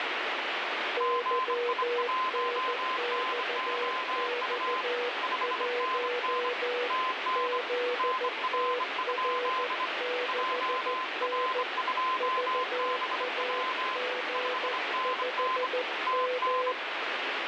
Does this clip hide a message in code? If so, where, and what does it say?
Yes: Morse code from 0.9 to 16.8 s, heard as two keyed tones, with heavy radio static. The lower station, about 14 wpm, 490 Hz: YNXX1 ZTR6N VAG5M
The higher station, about 25 wpm, 1030 Hz: GI1NOU 5NN TN NR? JR2BW 5NN TN